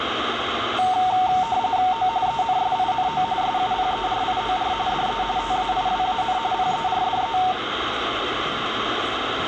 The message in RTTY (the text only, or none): O ENSINO SUPERIOR DE TAIWAN PERDE